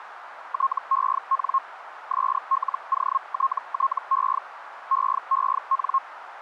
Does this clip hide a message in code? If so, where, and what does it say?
Yes: Hellschreiber (Feld-Hell, 122.5 baud) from 0.5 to 6.0 s, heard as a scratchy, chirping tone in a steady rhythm, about 1080 Hz, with radio static and a narrow filter. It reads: TEN SLOTTE EEN